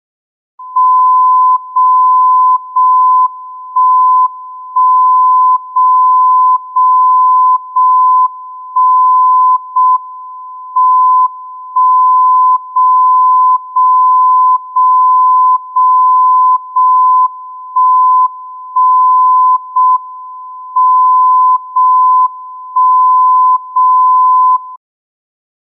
Radio time signal (JJY), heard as a tone whose level steps once a second, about 1010 Hz. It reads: 0 0 1 1 0 0 0 1 0 M 1 0 0 0 0 0 1 1 0 M 0 1 0 0